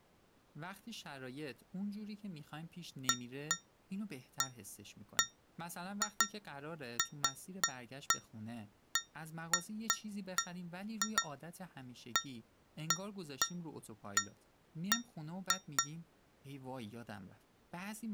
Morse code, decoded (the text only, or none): none